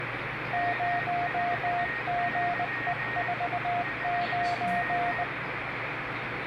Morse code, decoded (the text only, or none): 0GE49